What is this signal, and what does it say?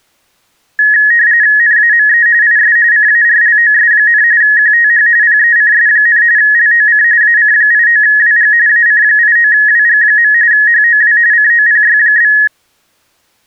RTTY (45.45 baud, 170 Hz shift), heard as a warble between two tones, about 1800 Hz centre. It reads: NAME IS CARLOS, QTH PECS, LOC AC89WG AC89WG. HOW COPY?